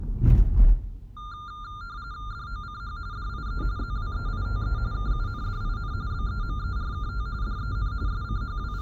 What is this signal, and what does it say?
RTTY (45.45 baud, 170 Hz shift), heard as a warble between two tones, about 1300 Hz centre, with the noise inside a car. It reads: DOCH DIE ZWEITE KUNDIN BEMERKT DEN …